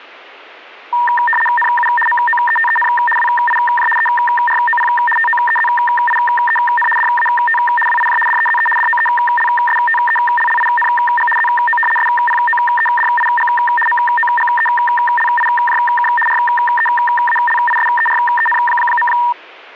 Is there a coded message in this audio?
Yes: RTTY (75 baud, 850 Hz shift) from 0.9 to 19.3 s, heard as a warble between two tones, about 1390 Hz centre. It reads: NU MOETEN WIJ EROP TOEZIEN DAT WIJ DEZE DOELSTELLING ZO SPOEDIG MOGELIJK REALISEREN.